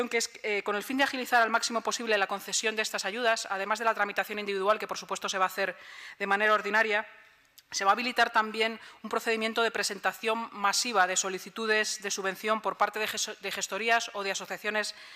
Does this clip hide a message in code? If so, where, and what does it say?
No.